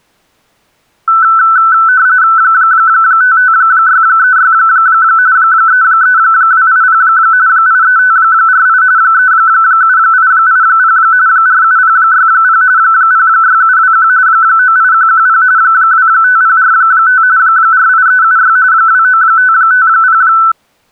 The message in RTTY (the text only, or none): 55636 33280 83548 37880 47060 06721 98110 25045 48376 29550